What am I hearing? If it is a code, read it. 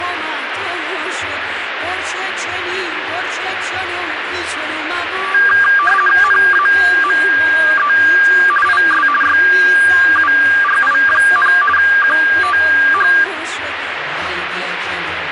RTTY (50 baud, 450 Hz shift), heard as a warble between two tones, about 1390 Hz centre, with radio static. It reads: NAME IS YURI, QTH